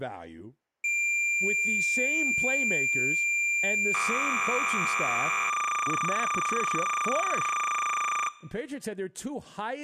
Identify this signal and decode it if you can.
Cassette data (Kansas City type), 300 baud, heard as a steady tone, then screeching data, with speech in English.